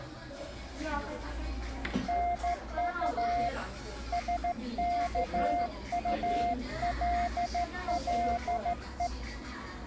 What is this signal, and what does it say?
Morse code, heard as a keyed tone, hand-sent with a straight key, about 14 wpm, 700 Hz, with the noise of a cafe. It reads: NU SKULLE